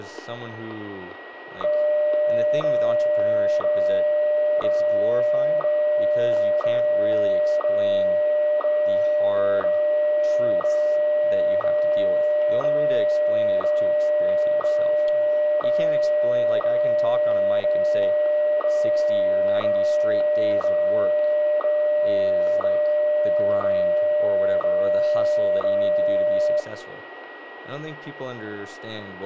Radio time signal (WWVH, Hawaii), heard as ticks, one a second, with radio static, static crashes, a steady whistle near 1910 Hz, room echo and speech in English.